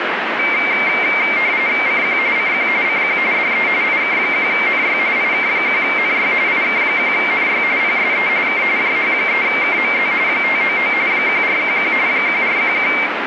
RTTY (45.45 baud, 170 Hz shift), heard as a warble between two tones, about 2200 Hz centre, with radio static. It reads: CQ CQ CQ DE IK1NY IK1NY IK1NY PSE K JH3KMZ 599 1411 1411